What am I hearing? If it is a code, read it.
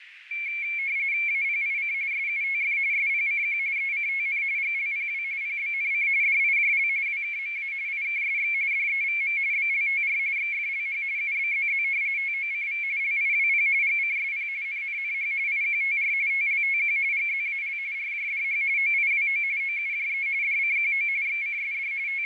RTTY (45.45 baud, 170 Hz shift), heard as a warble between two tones, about 2250 Hz centre, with radio static, fading and a narrow filter. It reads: APIC SUTF SPCQ ECTN GLPW PBNC DIJL WKMA IKSX DEVM BLTR XFLH UBZZ TOCV LIWP GCSP NNNH IQTR TLTQ GZAL RJDH OIWO OUJE DCQO XCSD …